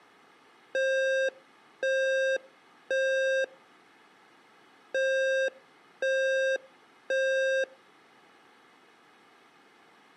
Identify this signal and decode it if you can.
Alarm pattern, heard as an alarm's beeps, played twice, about 530 Hz, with room echo. Temporal three. Smoke or fire, evacuate.